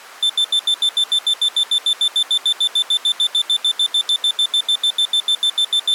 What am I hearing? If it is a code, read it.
Evenly repeated beeps. There is no code.